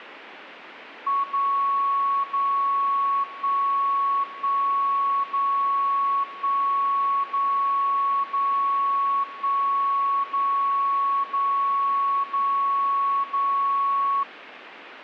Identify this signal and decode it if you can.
Radio time signal (DCF77), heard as a tone whose level steps once a second, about 1110 Hz. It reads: 0 0 1 1 0 1 0 0 1 0 0 0 0